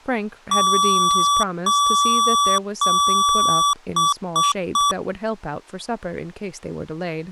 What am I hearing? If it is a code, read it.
Beep code, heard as beeps from a small speaker, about 1150 Hz, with speech in English. 3 long, 3 short.